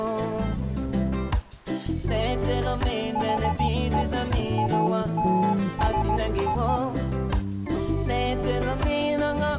Morse code (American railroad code), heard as a keyed tone, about 850 Hz. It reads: HE ALSO